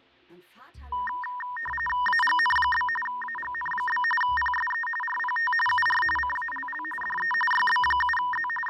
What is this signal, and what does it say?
RTTY (45.45 baud, 850 Hz shift), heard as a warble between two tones, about 1420 Hz centre, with fading. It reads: AGN? AGN? PSE RPT UR CALL DE YB7Z …